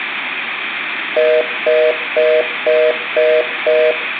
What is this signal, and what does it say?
Telephone call progress tone (North American plan), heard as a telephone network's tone, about 480, 620 Hz, 0.25 s on and 0.25 s off, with room echo. Congestion tone.